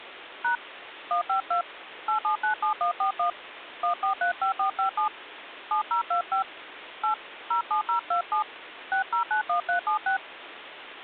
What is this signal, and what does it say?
DTMF, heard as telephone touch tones, dialled by hand, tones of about 110 ms, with phone line noise. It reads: # 152 8797141 1435457 7025 8 07027 6091376